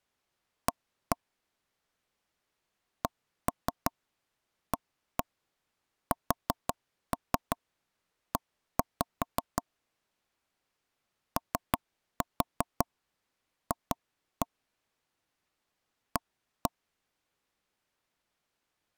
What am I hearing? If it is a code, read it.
Tap code, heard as knocks on wood, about 5 knocks a second. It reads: A CASE OF A